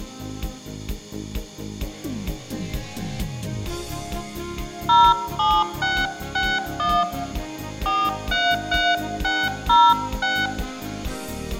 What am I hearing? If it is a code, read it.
DTMF, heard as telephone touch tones, dialled by hand, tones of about 240 ms, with room echo. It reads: 07661 433606